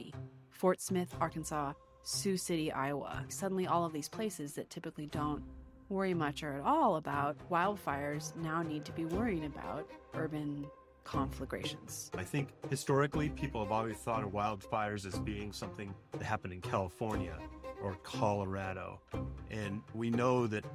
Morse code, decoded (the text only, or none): none